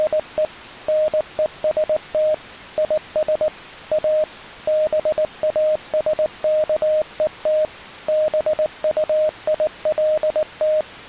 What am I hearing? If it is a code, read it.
Morse code, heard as a keyed tone, machine-sent, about 19 wpm, 620 Hz. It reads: … NEST IS A BASKET BUILT